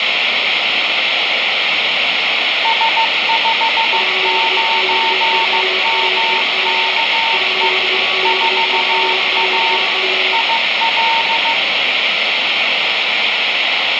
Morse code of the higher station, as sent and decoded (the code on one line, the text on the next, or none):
... ..... ----. -- -.- . / ....- .- / .. .-..
S59MKE 4A IL